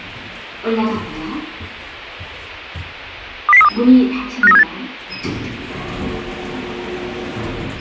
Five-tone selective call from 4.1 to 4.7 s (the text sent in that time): 59378